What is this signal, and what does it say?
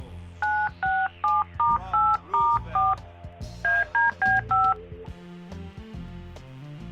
DTMF, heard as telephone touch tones, dialled by hand, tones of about 210 ms. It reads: 967*8*4 ADB5